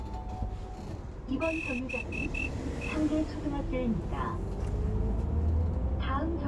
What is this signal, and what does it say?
Morse code (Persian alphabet), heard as a whistle, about 11 wpm, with the noise inside a bus. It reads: به